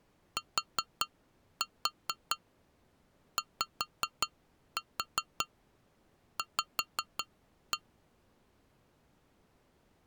Tap code, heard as taps on glass, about 5 knocks a second. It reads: TYV